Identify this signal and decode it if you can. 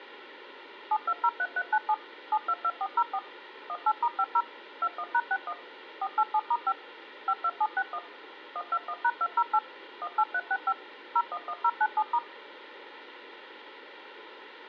DTMF, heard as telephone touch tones, dialled by machine, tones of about 60 ms. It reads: 7203397 722404 18*50 21#61 487*5 52761 121#208 18365 011097*